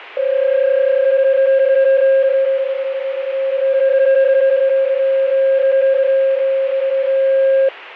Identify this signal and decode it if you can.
PSK31 (31.25 baud), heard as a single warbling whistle, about 540 Hz, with radio static and fading.